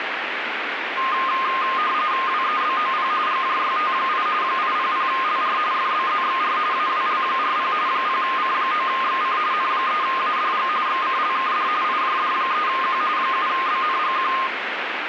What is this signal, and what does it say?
RTTY (45.45 baud, 170 Hz shift), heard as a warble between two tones, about 1140 Hz centre, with radio static. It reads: WEBOP GJYT8 800LR FBZXR AWL40 0C9XC N3ADG XCLKD IJD3Q 7BNGQ